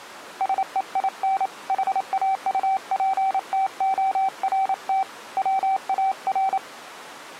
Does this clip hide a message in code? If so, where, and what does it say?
Yes: Morse code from 0.3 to 6.6 s, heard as a keyed tone, hand-sent with a paddle, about 28 wpm, 770 Hz. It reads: SEIN HAUPTORT WAR